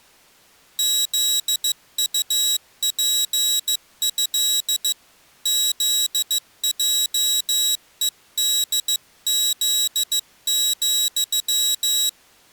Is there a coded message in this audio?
Yes: Morse code (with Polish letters) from 0.7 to 12.2 s, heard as a high beeper, hand-sent with a paddle, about 15 wpm, 3850 Hz. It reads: ZUPĘ ZJEDZ,